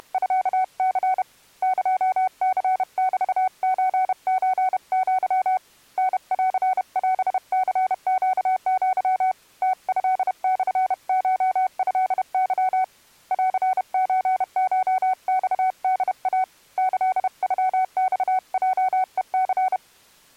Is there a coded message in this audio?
Yes: Morse code (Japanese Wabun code) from 0.0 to 19.8 s, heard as a keyed tone, hand-sent with a paddle, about 31 wpm, 750 Hz. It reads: … エニメソソア タンオニネア ムトモコトケ ンソコマホイ キノマヲヘニ